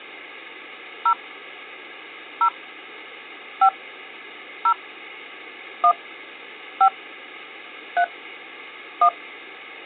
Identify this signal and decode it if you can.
DTMF, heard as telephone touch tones, dialled by hand, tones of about 80 ms, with hum. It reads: 0 0 5 0 1 5 3 1